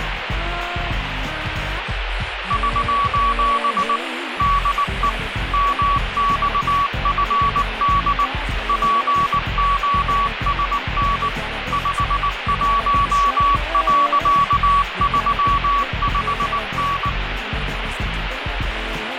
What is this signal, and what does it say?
Morse code, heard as a keyed tone, machine-sent, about 19 wpm, 1130 Hz, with radio static. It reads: <SOS> DE MXFD POSN 51.35N